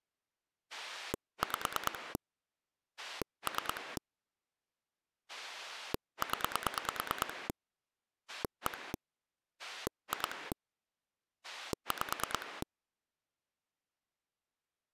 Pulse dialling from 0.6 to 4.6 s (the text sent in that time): 5 3